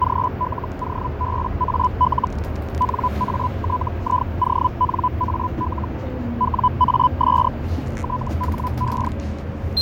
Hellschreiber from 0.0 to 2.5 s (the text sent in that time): GLOBAL